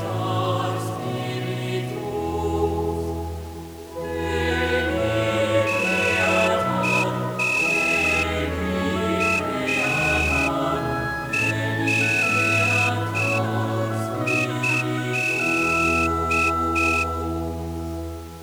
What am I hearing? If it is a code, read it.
Morse code (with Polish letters), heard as a whistle, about 5 wpm. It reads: KARĘ